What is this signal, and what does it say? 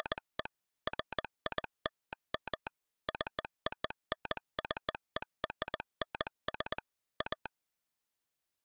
Morse code (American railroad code), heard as a telegraph sounder, machine-sent. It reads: … FILM CONCERNS A